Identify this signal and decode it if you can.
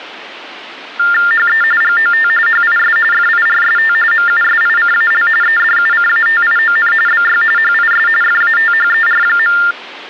TTY/TDD text telephone tones (45.45 baud Baudot), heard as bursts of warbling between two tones, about 400 Hz shift, 1600 Hz centre. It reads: HE GOT HIS FIRST MUSICAL EDUCATION BY HIS FATHER.